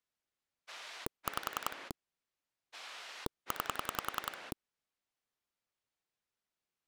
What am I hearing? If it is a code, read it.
Pulse dialling, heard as a rotary dial, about 10 pulses a second. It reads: 5 9